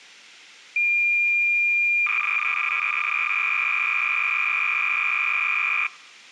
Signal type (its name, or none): cassette data (Kansas City type)